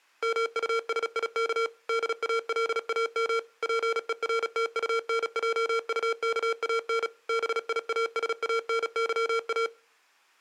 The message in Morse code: MUSIK DALAM PERTUNJUKAN BIASANYA

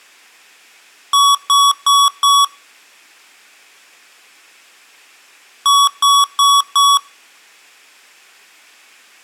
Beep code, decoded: 4 short

